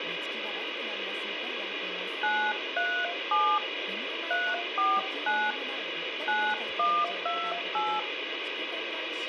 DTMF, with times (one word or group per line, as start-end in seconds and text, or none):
2.2-3.6 937
4.3-5.5 349
6.3-8.0 9128